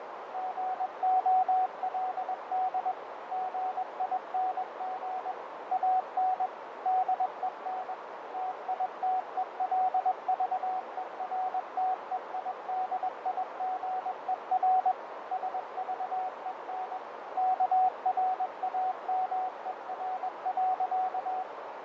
Morse code, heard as a keyed tone, machine-sent, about 21 wpm, 750 Hz, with heavy radio static, fading and a narrow filter. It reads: GOLD GING AN DEN TITELVERTEIDIGER SVEN KRAMER.